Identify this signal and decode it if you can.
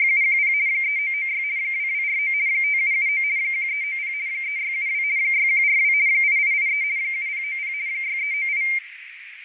RTTY (50 baud, 170 Hz shift), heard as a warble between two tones, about 2200 Hz centre, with radio static, fading and a narrow filter. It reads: … 3996 2249 5779 1390 3672 6142 8883 7090 6398